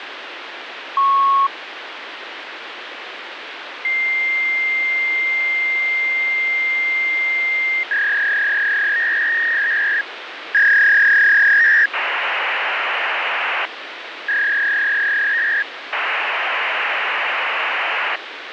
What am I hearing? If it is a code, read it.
Fax machine handshake, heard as a beep, a long tone, a warble and hiss, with phone line noise.